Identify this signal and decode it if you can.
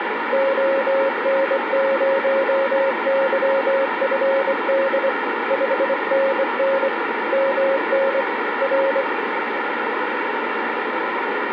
Morse code, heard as a keyed tone, hand-sent with a straight key, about 24 wpm, 540 Hz, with radio static. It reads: ON0YFD 5NN MN R